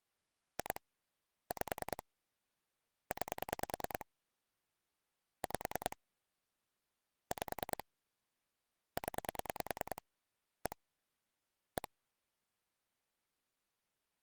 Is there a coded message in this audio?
Yes: pulse dialling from 0.6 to 11.9 s, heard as clicks on a phone line, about 10 pulses a second. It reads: 2 5 9 5 5 0 1 1